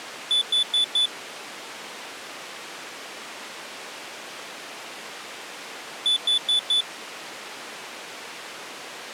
Alarm pattern, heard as an alarm's beeps, played twice, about 3500 Hz. Temporal four. Carbon monoxide.